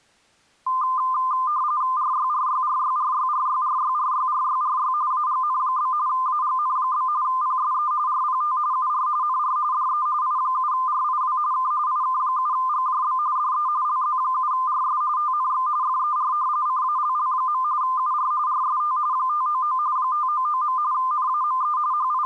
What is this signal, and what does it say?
RTTY (45.45 baud, 170 Hz shift), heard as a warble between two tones, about 1120 Hz centre. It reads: RYRYRYRYRYRYRYRYRY AGN? AGN? PSE RPT UR NR DE I7RIW K IK7GJB DE LZ7RS TNX FER CALL. UR RST 599 599. NAME …